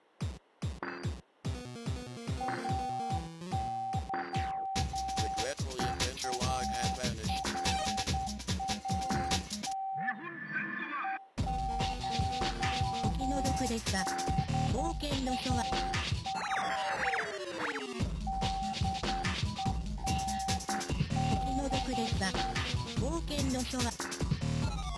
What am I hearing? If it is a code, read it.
Morse code (Persian alphabet), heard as a keyed tone, hand-sent with a straight key, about 10 wpm, 770 Hz, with room echo. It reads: اظهارات هشدار دهنده